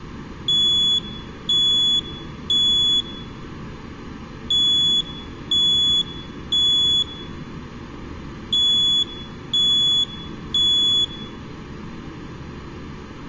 Alarm pattern, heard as an alarm's beeps, played three times, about 3400 Hz, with room echo. Temporal three. Smoke or fire, evacuate.